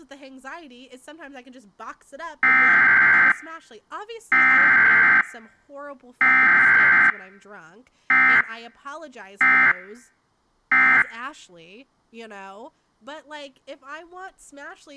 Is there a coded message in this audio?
Yes: Emergency Alert System (SAME) tones (header bursts, then end-of-message bursts) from 2.4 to 11.0 s, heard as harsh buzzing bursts, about 520.83 baud, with speech in English.